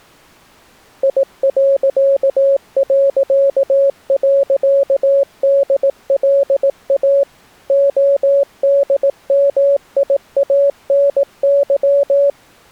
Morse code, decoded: I...DLA ODMIANY

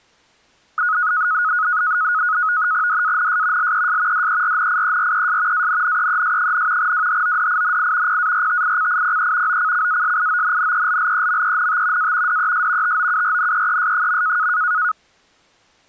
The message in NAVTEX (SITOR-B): DANS LES DERNIERES ANNEES, WHODINI PARTICIPE OCCASIONNELLEMENT A DES TOURNEES.

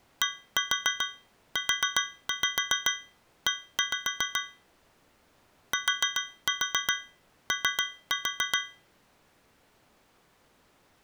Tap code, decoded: DUE TO

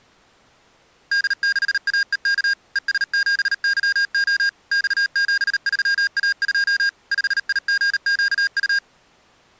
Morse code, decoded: D6AEK ES7YO X73A2 5IGQU

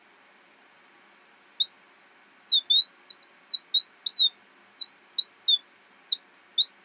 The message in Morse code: none

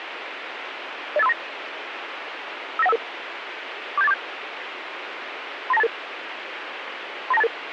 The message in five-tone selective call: 08539 59155 47847 39288 39288

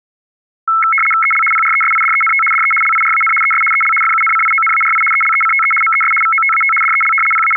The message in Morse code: none

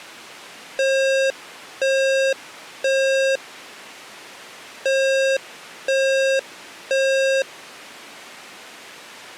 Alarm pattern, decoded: temporal three

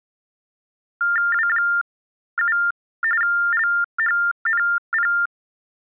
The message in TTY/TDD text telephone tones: W7 LHNP

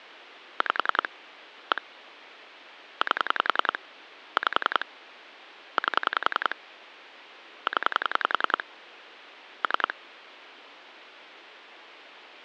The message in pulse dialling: 5 1 8 5 8 0 3

